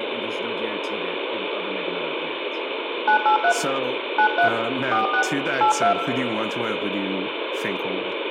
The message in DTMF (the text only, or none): 983 93 46 82